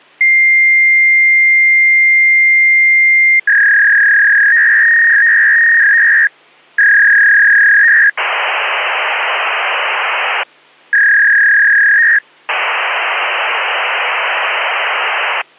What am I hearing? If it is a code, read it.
Fax machine handshake, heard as a long tone, a warble and hiss.